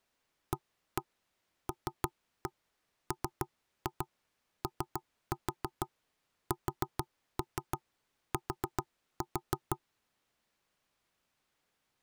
Tap code, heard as knocks on wood, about 6 knocks a second. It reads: ALMOST